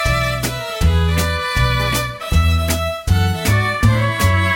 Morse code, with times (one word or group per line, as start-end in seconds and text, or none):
none